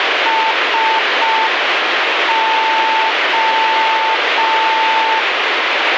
Morse code, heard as a keyed tone, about 5 wpm, 890 Hz, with radio static. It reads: SO